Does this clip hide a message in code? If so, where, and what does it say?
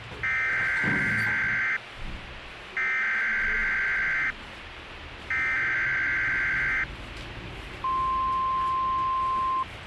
Yes: Emergency Alert System (SAME) tones (header bursts, then the 1050 Hz attention tone) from 0.2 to 9.6 s, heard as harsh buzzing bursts, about 520.83 baud, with radio hiss and the noise inside a lift.